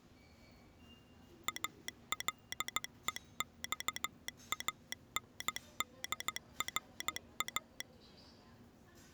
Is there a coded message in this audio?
Yes: Morse code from 1.4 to 7.9 s, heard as a telegraph sounder, machine-sent, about 15 wpm, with the noise of a subway station. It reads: ALEXANDRA